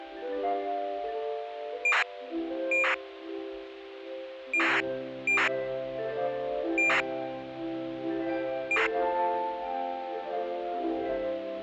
ACARS aircraft data, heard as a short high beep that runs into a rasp, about 2400 baud.